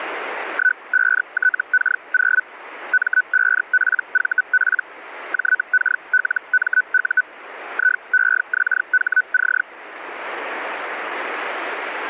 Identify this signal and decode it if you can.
Hellschreiber (Feld-Hell, 122.5 baud), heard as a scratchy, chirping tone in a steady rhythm, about 1500 Hz. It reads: 15TK0 M5PVP JKLMU IEXHC